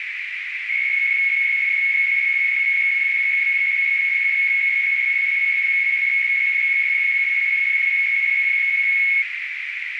PSK63 (62.5 baud), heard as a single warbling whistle, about 2200 Hz, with radio static and a narrow filter.